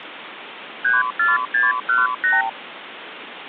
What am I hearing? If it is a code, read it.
Multi-frequency trunk signalling (R2, with the far end's replies), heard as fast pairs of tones, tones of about 170 ms, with phone line noise. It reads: 34618